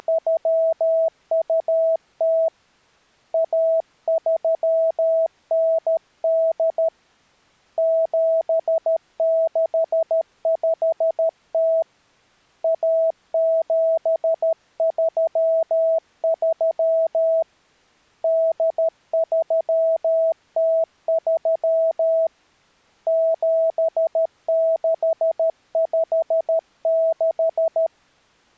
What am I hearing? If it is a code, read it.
Morse code (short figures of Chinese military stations), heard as a keyed tone, hand-sent with a paddle, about 13 wpm, 650 Hz. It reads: … 1398 7650 1733 8303 7656